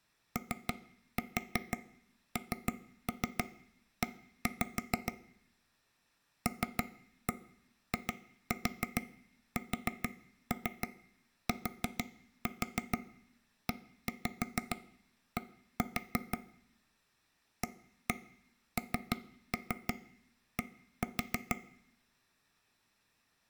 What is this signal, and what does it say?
Tap code, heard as taps on a table, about 6 knocks a second, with room echo. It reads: ONE LISTED AND